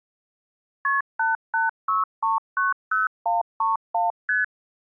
Multi-frequency trunk signalling (R1, as on North American trunks), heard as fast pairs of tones, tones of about 160 ms. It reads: KP 886390131 ST